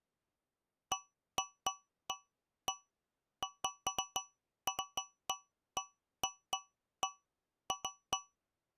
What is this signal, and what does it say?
Irregular taps on a metal pipe. There is no code.